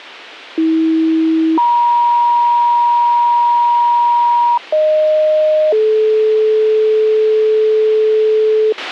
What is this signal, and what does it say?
Two-tone page, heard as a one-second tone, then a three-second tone, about 320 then 950 Hz, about 620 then 430 Hz, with a squelch burst at the end.